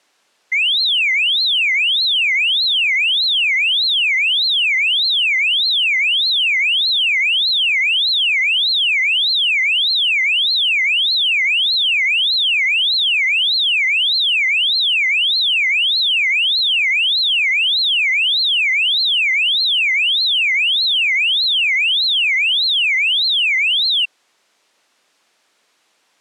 A tone that sweeps in pitch again and again. There is no code.